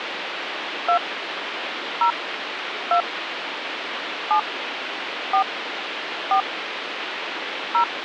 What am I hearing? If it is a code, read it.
DTMF, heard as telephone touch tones, dialled by hand, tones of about 90 ms, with phone line noise. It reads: 2 0 2 7 4 4 0